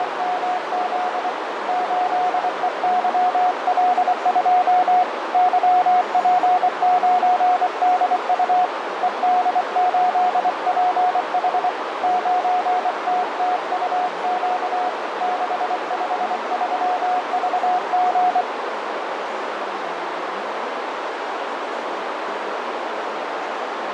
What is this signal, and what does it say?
Morse code, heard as a keyed tone, hand-sent with a bug key, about 24 wpm, 730 Hz, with heavy radio static, fading and a narrow filter. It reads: … 8EYL2 YP9DU ED8PH 9TTUQ 653VG